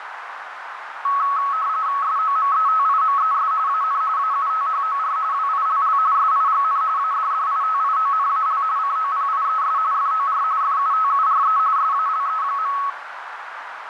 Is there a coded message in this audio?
Yes: RTTY (45.45 baud, 170 Hz shift) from 1.0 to 12.9 s, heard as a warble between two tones, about 1200 Hz centre, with radio static and a narrow filter. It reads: SOMETIMES AN AUTHOR WILL SIGN ADDITIONAL COPIES FOR FUTURE SALE.